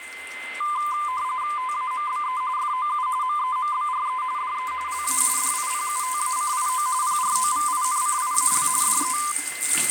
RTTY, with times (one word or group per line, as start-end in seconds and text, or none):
1.6-2.4 TAMBE
2.6-3.1 FOU
3.2-4.2 MEMBRE
4.4-4.7 DE
4.9-5.2 LA
5.4-6.9 DIPUTACIO
7.0-8.7 PROVINCIAL
8.8-9.2 DE